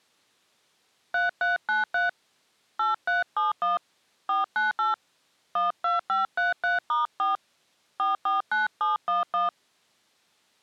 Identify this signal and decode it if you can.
DTMF, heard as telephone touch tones, dialled by hand, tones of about 150 ms. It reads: 3393 8371 498 12533*4 449711